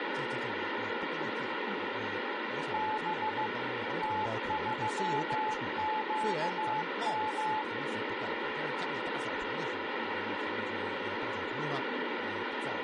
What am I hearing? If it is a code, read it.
Morse code, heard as a keyed tone, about 15 wpm, 860 Hz, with radio static and speech in Chinese. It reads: B T3QM